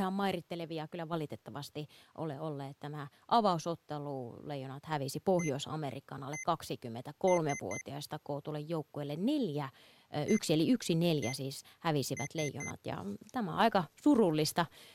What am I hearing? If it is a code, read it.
Beep code, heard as beeps from a small speaker, played twice, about 2050 Hz, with speech in Finnish. 1-1-3. In Phoenix BIOS tables: CMOS read or write failure.